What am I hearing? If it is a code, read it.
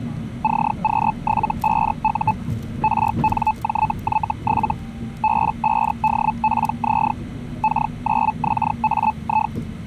Hellschreiber (Feld-Hell, 122.5 baud), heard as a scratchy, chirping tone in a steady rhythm, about 870 Hz, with the noise inside a bus. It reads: CQ75U RNJY7 B5DPZ K9XAI